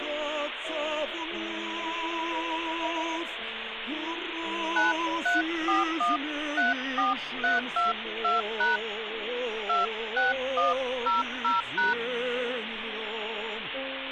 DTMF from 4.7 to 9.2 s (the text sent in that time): 934134322#